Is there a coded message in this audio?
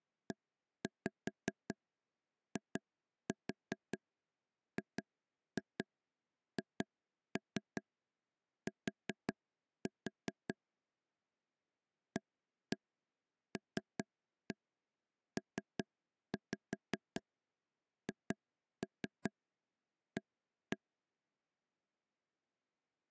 Yes: tap code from 0.3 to 20.8 s, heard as taps on a table, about 5 knocks a second. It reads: EIGHT ALPHA